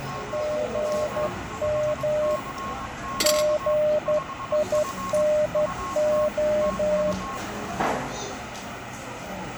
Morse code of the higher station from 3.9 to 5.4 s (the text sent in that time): 5F